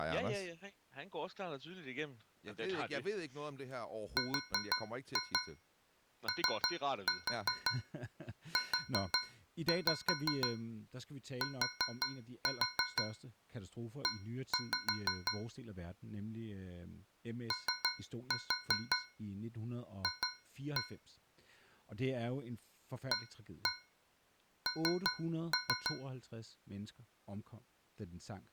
Tap code, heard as taps on a metal pipe, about 5 knocks a second, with speech in Danish. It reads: ROUTE OF AN